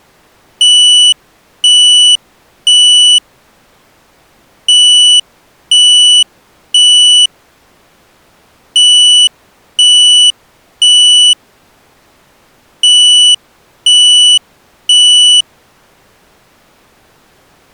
Alarm pattern, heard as an alarm's beeps, played four times, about 2950 Hz. Temporal three. Smoke or fire, evacuate.